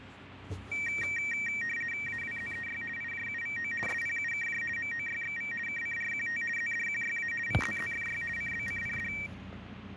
RTTY (50 baud, 450 Hz shift), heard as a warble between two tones, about 2100 Hz centre, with radio static and the noise inside a car. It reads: AWZEY IJUVO SPUKJ MOYXV KCRQT ZDQYA VZZFY CBCPD